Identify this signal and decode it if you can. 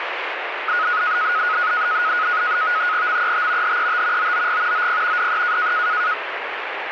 NAVTEX (SITOR-B), 100 baud, 170 Hz shift, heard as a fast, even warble, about 1360 Hz centre, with radio static. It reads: MET HET OOG OP DE